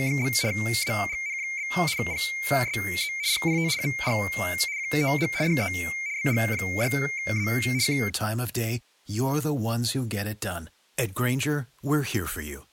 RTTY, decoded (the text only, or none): … AGN? PSE RPT UR QTH DE BG6A K